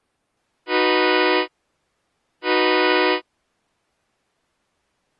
Train horn signal, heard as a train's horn. 2 short. On North American railways: a signal is acknowledged.